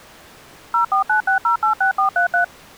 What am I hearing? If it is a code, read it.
DTMF, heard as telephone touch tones, dialled by machine, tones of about 110 ms. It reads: 0496086433